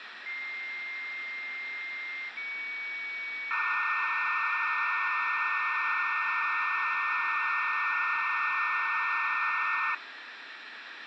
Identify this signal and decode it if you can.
Dial-up modem handshake (low-speed, two carriers), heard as two whistles, then hiss, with phone line noise.